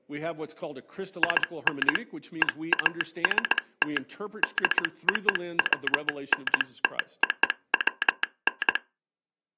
Morse code (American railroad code), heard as a telegraph sounder, machine-sent, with speech in English. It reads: IN EAST DOWNTOWN